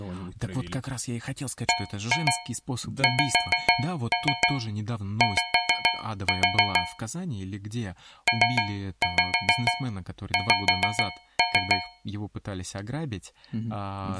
Tap code, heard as taps on a metal pipe, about 6 knocks a second, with speech in Russian. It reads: BXY PX